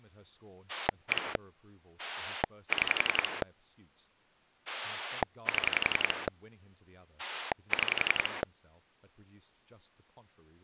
Pulse dialling, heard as a rotary dial, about 11 pulses a second, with speech in English. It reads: 1 6 7 6